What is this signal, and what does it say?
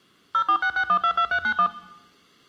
DTMF, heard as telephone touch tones, dialled by machine, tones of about 80 ms. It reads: 0466122391